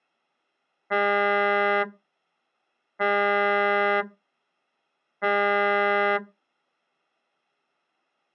Ship horn signal, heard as a ship's horn, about 200 Hz. 3 short. At sea: I am operating astern propulsion.